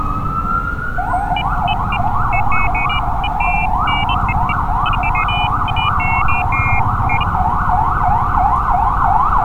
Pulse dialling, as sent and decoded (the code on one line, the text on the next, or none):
none